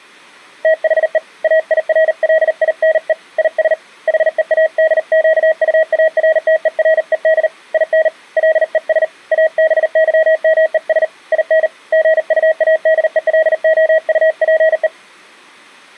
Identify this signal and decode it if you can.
Morse code, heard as a keyed tone, hand-sent with a paddle, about 39 wpm, 640 Hz. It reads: THE AIRLINE IS HEADQUARTERED IN LES ABYMES IN GUADELOUPE